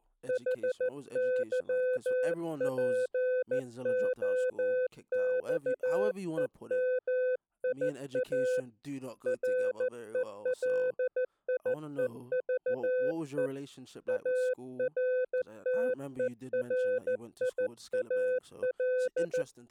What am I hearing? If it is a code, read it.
Morse code, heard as a keyed tone, hand-sent with a paddle, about 14 wpm, 510 Hz, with speech in English. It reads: HYPOXEMIA RELIEVE ARTERIAL